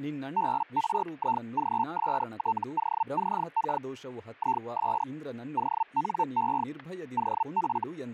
Hellschreiber (Feld-Hell, 122.5 baud), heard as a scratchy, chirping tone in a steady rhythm, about 900 Hz, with static crashes and speech in Kannada. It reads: BRIGSTOCK IS ONE OF